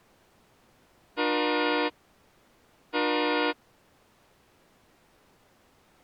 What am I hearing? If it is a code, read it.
Train horn signal, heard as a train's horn. 2 short. On North American railways: a signal is acknowledged.